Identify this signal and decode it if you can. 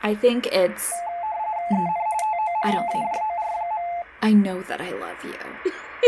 RTTY (45.45 baud, 170 Hz shift), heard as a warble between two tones, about 780 Hz centre, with speech in English. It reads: EN TO MAJOR.